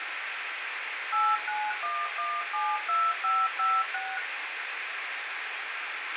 DTMF, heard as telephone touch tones, dialled by machine, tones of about 230 ms, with radio hiss and a squelch burst at the end. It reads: 891172556